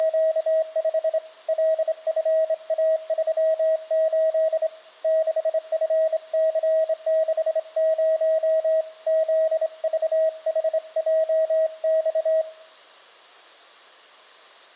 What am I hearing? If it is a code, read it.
Morse code, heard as a keyed tone, hand-sent with a straight key, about 26 wpm, 640 Hz, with room echo. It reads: … LFA38 6FC60 ZVHJX